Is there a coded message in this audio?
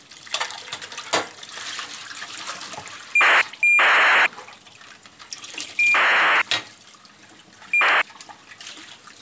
Yes: ACARS aircraft data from 3.2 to 8.0 s, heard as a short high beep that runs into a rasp, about 2400 baud, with kitchen noise.